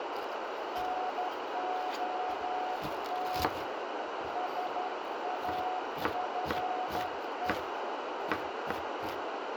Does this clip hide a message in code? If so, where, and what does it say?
Yes: Morse code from 0.7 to 7.6 s, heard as a keyed tone, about 12 wpm, 740 Hz, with heavy radio static, a narrow filter and kitchen noise. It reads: NOT SAFE